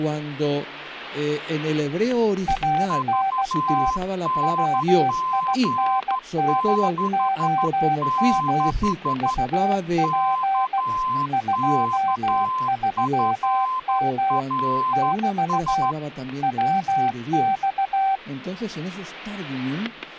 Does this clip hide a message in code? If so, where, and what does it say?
Yes: Morse code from 2.4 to 18.2 s, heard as two keyed tones, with static crashes. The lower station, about 16 wpm, 780 Hz: ANT WINDOM UP 23M <BT> WX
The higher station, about 12 wpm, 1030 Hz: VNG66 KKFRS